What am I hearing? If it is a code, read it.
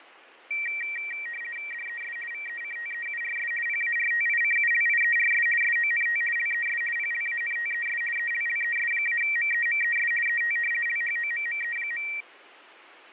RTTY (50 baud, 450 Hz shift), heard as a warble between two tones, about 2100 Hz centre, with radio static and fading. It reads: DES VECTEURS PARTICULIERS SONT LES PLANTES ELLES-MEMES ET LHOMME.